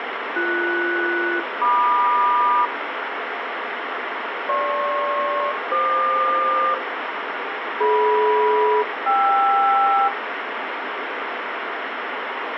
Aircraft SELCAL, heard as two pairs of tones, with radio static and room echo. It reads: BS-MQ GP-FQ DM-KR